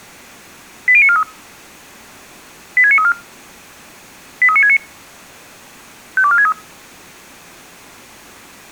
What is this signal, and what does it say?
Five-tone selective call (ZVEI), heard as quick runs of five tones, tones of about 70 ms. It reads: 80943 86934 83969 52463